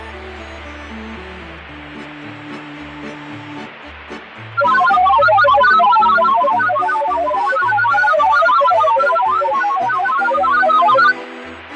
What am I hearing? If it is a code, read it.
Multi-tone FSK (Olivia or MFSK type), about 1000 Hz wide, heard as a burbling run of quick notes, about 31.25 baud, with radio static and fading.